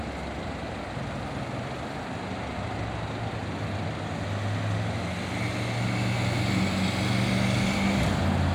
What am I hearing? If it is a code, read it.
Street noise. There is no code.